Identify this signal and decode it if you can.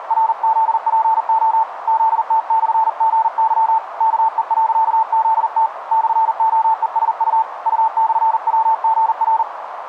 Morse code, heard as a keyed tone, hand-sent with a paddle, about 40 wpm, 890 Hz, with radio static and a narrow filter. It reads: … ZT/GY KE.ZT /OESU U/WGR